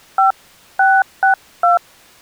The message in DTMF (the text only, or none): 5662